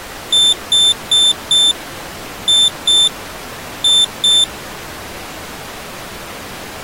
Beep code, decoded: 4-2-2

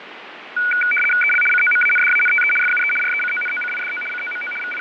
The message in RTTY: EL COMANDANTE FUE RECONOCIDO COMO …

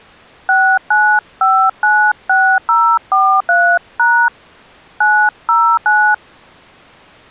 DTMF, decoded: 69596043# 909

